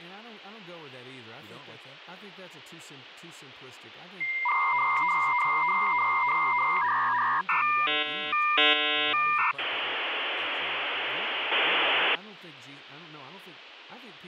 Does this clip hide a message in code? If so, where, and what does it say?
Yes: dial-up modem handshake (V.34 or later) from 4.2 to 12.2 s, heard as a whistle, warbles, then hiss, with phone line noise and speech in English.